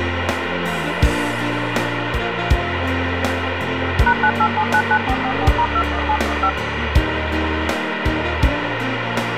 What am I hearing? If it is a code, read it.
DTMF, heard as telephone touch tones, dialled by machine, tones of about 70 ms, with radio hiss. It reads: #98799444*21715